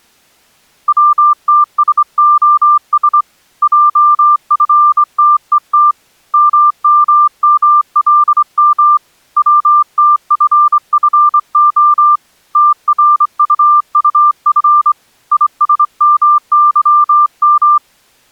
Morse code, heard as a keyed tone, hand-sent with a straight key, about 24 wpm, 1190 Hz. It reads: WTSOS JFTET MMMLM WTFFO TRUUF ISMYM